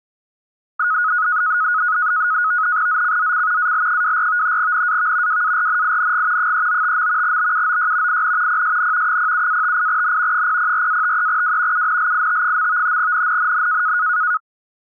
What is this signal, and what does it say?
NAVTEX (SITOR-B), 100 baud, 170 Hz shift, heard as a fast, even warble, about 1360 Hz centre. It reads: ZCZC AL24 NAV WARNING 395. BUOY IN PSN 07-58N 004-53W UNLIT. NNNN